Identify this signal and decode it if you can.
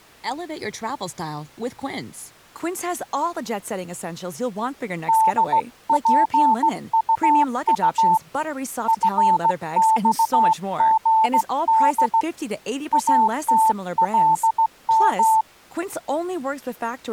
Morse code, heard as a keyed tone, hand-sent with a straight key, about 16 wpm, 880 Hz, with speech in English. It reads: DPUU FXGD ATLM